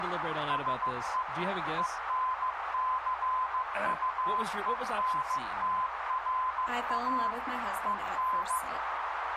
Morse code, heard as a keyed tone, machine-sent, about 15 wpm, 1020 Hz, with radio static, a narrow filter and speech in English. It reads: SE ENCUENTRA EN